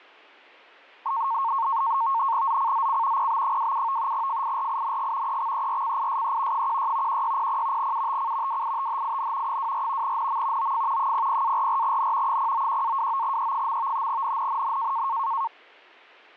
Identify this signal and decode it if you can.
NAVTEX (SITOR-B), 100 baud, 170 Hz shift, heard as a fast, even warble, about 1000 Hz centre. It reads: ZCZC PB27 FIRING EXERCISE 16 1600 UTC WITHIN 24 NM OF 00-44N 091-29E. NNNN